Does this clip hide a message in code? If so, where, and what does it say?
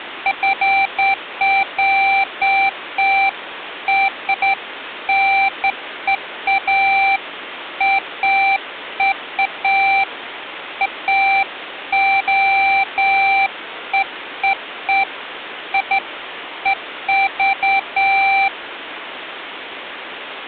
No, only beeps of irregular length, with phone line noise.